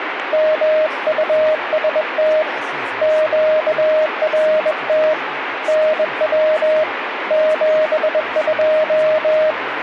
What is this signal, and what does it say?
Morse code, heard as a keyed tone, hand-sent with a bug key, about 21 wpm, 620 Hz, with radio static and speech in English. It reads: MUST QRT NW 72